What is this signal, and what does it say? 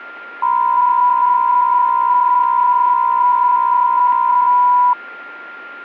PSK63 (62.5 baud), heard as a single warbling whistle, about 990 Hz, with a steady whistle near 1400 Hz.